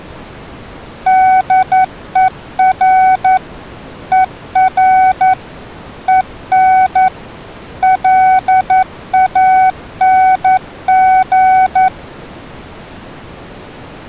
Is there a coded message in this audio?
Yes: Morse code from 1.0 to 11.9 s, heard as a keyed tone, machine-sent, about 11 wpm, 750 Hz. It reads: DER ER EN LANG